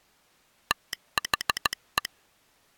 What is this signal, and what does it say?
Morse code, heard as a telegraph sounder, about 15 wpm. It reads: THE